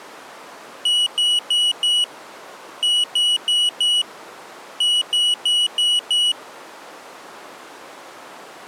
Beep code, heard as a piezo beeper, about 2950 Hz. 4-4-5.